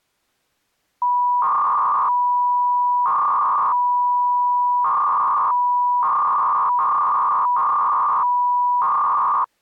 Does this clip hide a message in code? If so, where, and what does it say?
Yes: 300-baud modem data (V.21 tones) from 1.0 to 9.4 s, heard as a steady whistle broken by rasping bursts, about 300 baud, 200 Hz shift.